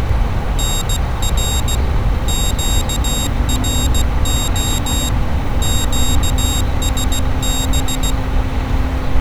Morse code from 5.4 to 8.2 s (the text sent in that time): QSB